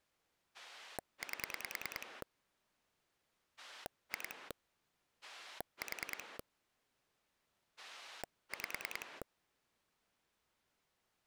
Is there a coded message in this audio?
Yes: pulse dialling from 0.5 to 9.2 s, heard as a rotary dial, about 10 pulses a second. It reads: 8 2 4 5